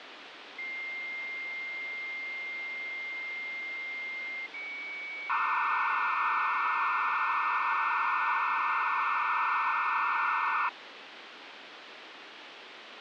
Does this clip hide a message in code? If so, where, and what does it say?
Yes: dial-up modem handshake (low-speed, two carriers) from 0.6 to 10.7 s, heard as two whistles, then hiss, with phone line noise.